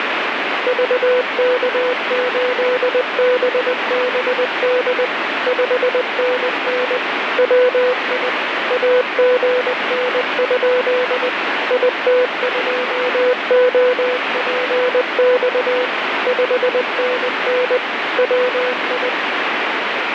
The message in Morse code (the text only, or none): VK8BBD 5NN WI AGN? IT2OPX 5NN WI